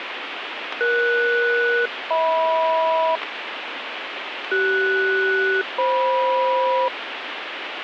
Aircraft SELCAL, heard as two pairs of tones, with radio static. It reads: ES-HM CS-FM